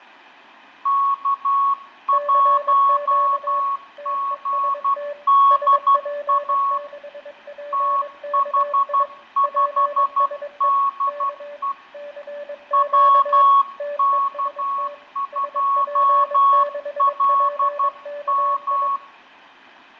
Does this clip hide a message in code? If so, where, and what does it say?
Yes: Morse code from 0.8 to 19.0 s, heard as two keyed tones, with fading and room echo. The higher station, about 12 wpm, 1110 Hz: K1GDA TH5DE WK2LM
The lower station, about 22 wpm, 580 Hz: CQ TEST SP6PKI PSE K CQ TEST SP6PKI